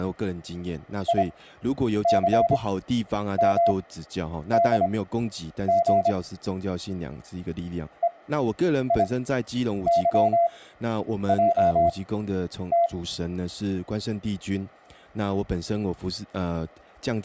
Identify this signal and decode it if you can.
Morse code, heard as a keyed tone, machine-sent, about 26 wpm, spaced as for 9 wpm, 680 Hz, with speech in Chinese. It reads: ICMDG EIYJT